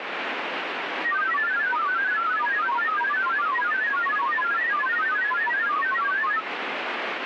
Multi-tone FSK (Olivia or MFSK type), about 1000 Hz wide, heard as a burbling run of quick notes, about 31.25 baud, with radio static.